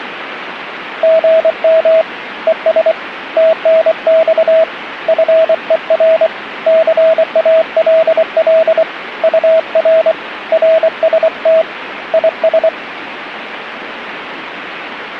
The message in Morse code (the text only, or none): GM ES TNX FER CALL UR RST IS